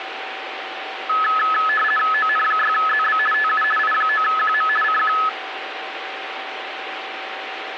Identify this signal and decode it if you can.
RTTY (50 baud, 450 Hz shift), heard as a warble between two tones, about 1500 Hz centre, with radio static and a steady whistle near 770 Hz. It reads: ON6ZB TU I9QM CQ